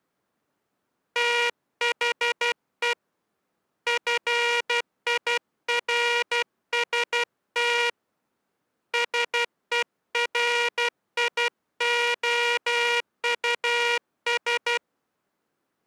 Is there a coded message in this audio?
Yes: Morse code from 1.1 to 14.8 s, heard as a buzzer, hand-sent with a paddle, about 12 wpm. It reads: THE FIRST SERIOUS